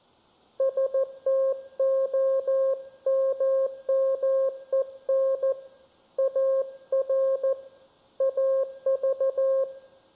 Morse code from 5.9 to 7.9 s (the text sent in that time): AR